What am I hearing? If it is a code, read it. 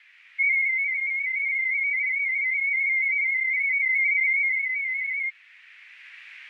Multi-tone FSK (Olivia or MFSK type), about 250 Hz wide, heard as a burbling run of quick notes, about 31.25 baud.